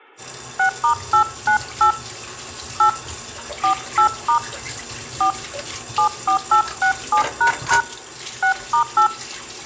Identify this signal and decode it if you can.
DTMF, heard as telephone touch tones, dialled by hand, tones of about 100 ms, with kitchen noise. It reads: 6*898 8 48* 4 74867## 6*8